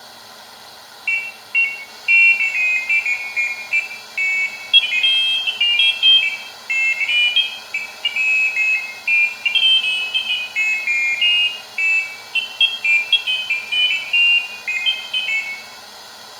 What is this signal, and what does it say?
Pairs of high tones at irregular times, with room echo. There is no code.